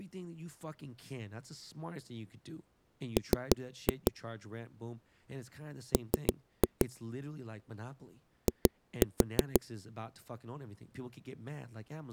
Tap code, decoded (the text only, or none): M M I